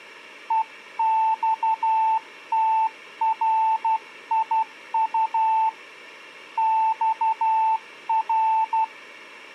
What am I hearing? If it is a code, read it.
Morse code, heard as a keyed tone, hand-sent with a paddle, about 12 wpm, 890 Hz. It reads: EXTRIU XR